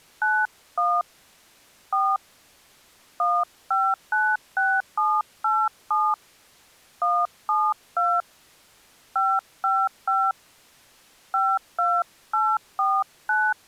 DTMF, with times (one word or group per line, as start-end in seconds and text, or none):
0.2-1.0 91
1.9-2.2 4
3.2-6.1 1596787
7.0-8.2 172
9.2-10.3 555
11.3-13.5 52849